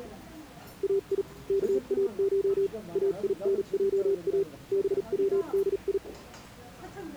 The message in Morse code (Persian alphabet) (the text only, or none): ای کاش اینجا بودی